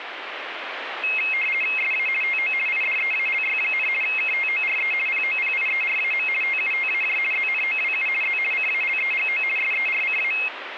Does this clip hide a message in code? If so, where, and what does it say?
Yes: RTTY (50 baud, 450 Hz shift) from 1.0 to 10.5 s, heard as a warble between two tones, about 2350 Hz centre, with radio static. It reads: SA TO IDEALY, KTORE POPIERAM TUTAJ ZNOWU Z CALEGO SERCA